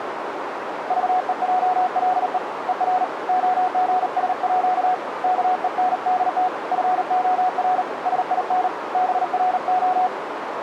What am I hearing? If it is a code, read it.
Morse code (with Danish letters), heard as a keyed tone, hand-sent with a paddle, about 38 wpm, 740 Hz, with radio static and a narrow filter. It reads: VEJLE ER OGSÅ KENDT FOR SIN BRO